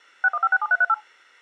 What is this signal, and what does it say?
DTMF, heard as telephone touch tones, dialled by machine, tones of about 40 ms. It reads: 61567338